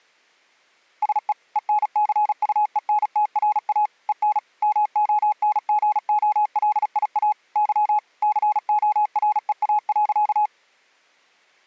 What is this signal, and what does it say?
Morse code, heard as a keyed tone, machine-sent, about 36 wpm, 840 Hz. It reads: SE ENCUENTRA EN MONGOLIA Y COREA.